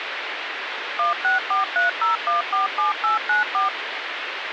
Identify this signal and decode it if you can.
DTMF, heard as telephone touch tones, dialled by machine, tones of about 140 ms, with phone line noise. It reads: 16430147894